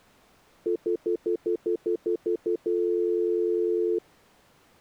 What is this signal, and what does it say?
Telephone call progress tone (North American plan), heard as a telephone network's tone, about 350, 440 Hz, 0.1 s on and 0.1 s off. Stutter dial tone.